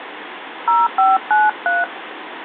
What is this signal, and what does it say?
DTMF, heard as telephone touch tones, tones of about 170 ms, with phone line noise. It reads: 0593